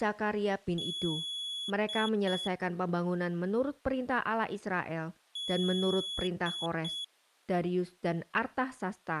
Beep code, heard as a piezo beeper, played twice, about 3400 Hz, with speech in Indonesian. 1 long, 2 short. In Award, IBM and AMI BIOS tables: video adapter failure.